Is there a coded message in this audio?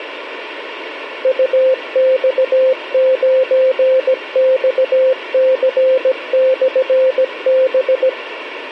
Yes: Morse code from 1.2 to 8.2 s, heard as a keyed tone, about 17 wpm, 520 Hz, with radio hiss. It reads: UX9XC/B